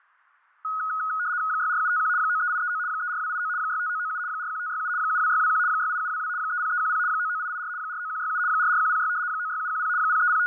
RTTY (75 baud, 170 Hz shift), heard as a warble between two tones, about 1360 Hz centre, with fading and static crashes. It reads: 64751 93839 34289 65997 41567 72621 68722 30310 99884 49167 44106 96710 …